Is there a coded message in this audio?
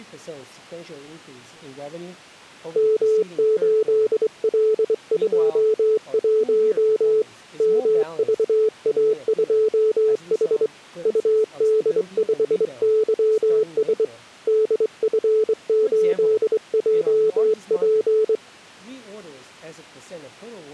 Yes: Morse code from 2.7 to 18.4 s, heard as a keyed tone, hand-sent with a straight key, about 23 wpm, 440 Hz. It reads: M8L21 MVA2H UD5YS DF8JP